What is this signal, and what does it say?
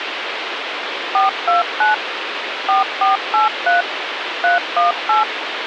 DTMF, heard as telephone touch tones, dialled by machine, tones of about 140 ms, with phone line noise. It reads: 429 4483 318